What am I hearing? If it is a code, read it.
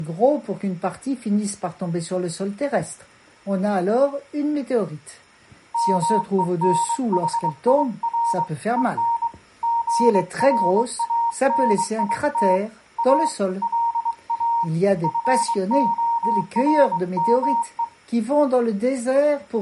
Morse code, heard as a keyed tone, hand-sent with a bug key, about 23 wpm, 930 Hz. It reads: MENHIR EN GRANIT A LA FORME